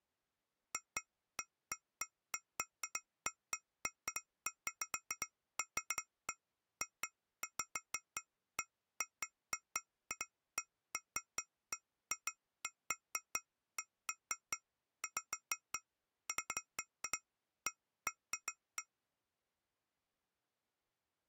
Irregular taps on glass. There is no code.